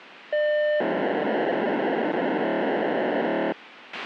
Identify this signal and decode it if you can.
POCSAG pager data (1200 baud), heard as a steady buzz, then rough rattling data, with radio hiss and a squelch burst at the end.